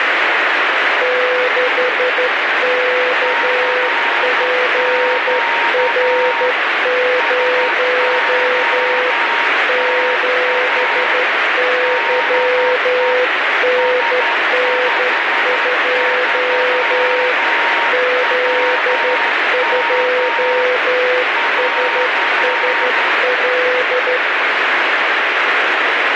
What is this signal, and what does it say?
Morse code, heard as two keyed tones, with heavy radio static. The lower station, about 12 wpm, 500 Hz: 6KPR0 7YNN2 Z2SSL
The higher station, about 11 wpm, 930 Hz: CQ SOTA DE S53WM <AR>